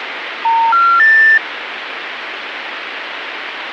Telephone call progress tone (North American plan), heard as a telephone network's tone, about 910, 1370, 1800 Hz, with phone line noise. Special information tone.